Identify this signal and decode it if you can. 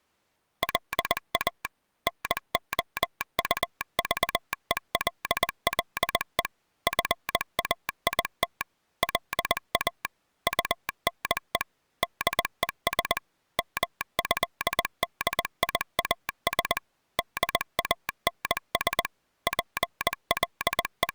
Morse code (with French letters), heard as a telegraph sounder, machine-sent, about 20 wpm. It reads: LA NOUVELLE FAIT LA UNE DES MÉDIAS DANS …